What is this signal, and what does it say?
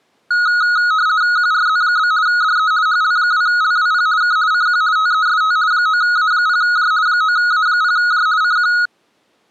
RTTY (50 baud, 170 Hz shift), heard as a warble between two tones, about 1360 Hz centre. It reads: QRZ? DE HL2LWP K CQ TEST 9A0J 9A0J CQ